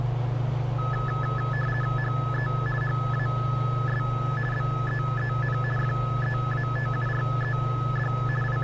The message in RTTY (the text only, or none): HE HAS BEEN FEATURED …